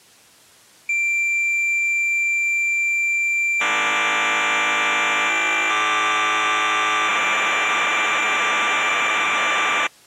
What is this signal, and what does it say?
Cassette data (Kansas City type), 1200 baud, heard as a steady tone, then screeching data.